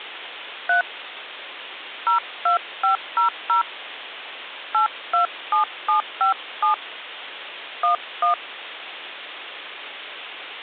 DTMF, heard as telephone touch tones, dialled by hand, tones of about 120 ms. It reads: 3 02500 827757 11